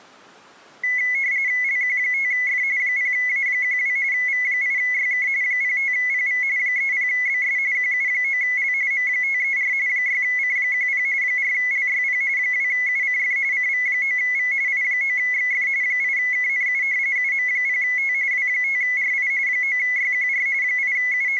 RTTY (45.45 baud, 170 Hz shift), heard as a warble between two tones, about 2100 Hz centre. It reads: LQ5F 0A12 V8YK 05PV 30BS QU9L M534 6C10 4LYP 2UCF CV9V I9XF 8KNU UM0T W5RI 9YQR …